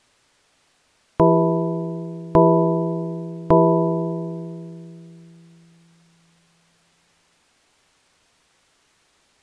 Clock strike, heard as a bell. 3. Three o'clock.